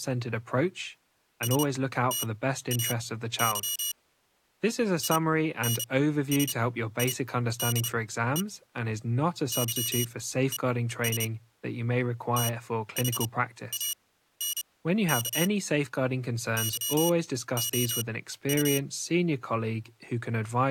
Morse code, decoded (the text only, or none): STAY INSIDE YES THANK YOU